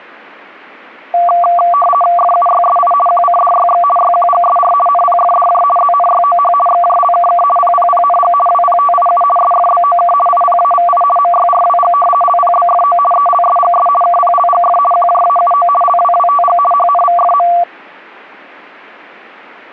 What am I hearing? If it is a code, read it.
RTTY (50 baud, 450 Hz shift), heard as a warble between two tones, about 920 Hz centre. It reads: FUYSI QCDYX YQGSR NPFDJ ZNYOH XJLKK PPPNG WPTIU SFBOK IPAVI MYRWG LPBFO ELSGS KPLGF QJAUO LWWTG HNVFM